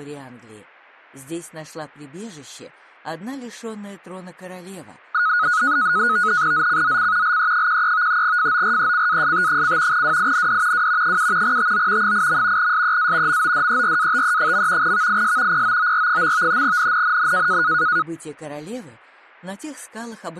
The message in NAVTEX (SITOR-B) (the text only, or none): ZCZC LE13 FORECAST: WIND W 7 TO 8. SEA MODERATE. VIS POOR. NNNN